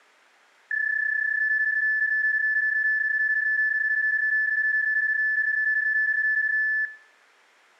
PSK31 (31.25 baud), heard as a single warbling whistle, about 1750 Hz, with room echo.